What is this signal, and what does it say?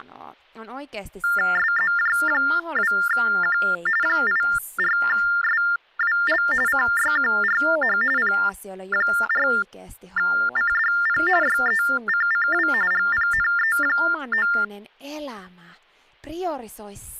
TTY/TDD text telephone tones (45.45 baud Baudot), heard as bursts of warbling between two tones, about 400 Hz shift, 1600 Hz centre, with hum and speech in Finnish. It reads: SZJ2Q 84SWL CYQRH P4CDP YECCW GPNE9